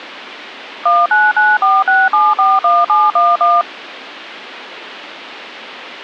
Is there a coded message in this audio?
Yes: DTMF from 0.9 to 3.6 s, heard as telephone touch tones, dialled by machine, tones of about 210 ms. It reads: 19946741711